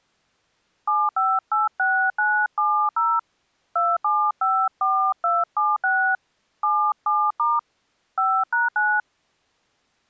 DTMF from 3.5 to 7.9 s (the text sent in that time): 2754276 77*